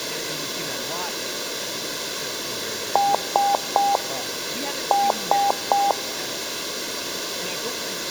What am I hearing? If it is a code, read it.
Beep code, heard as beeps, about 800 Hz, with room echo and speech in English. 3-3.